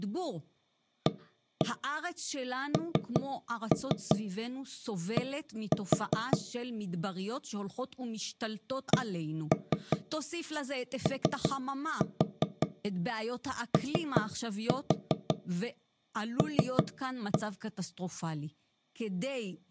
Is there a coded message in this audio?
Yes: tap code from 1.1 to 17.4 s, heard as knocks on wood, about 5 knocks a second, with speech in Hebrew. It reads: AND COOL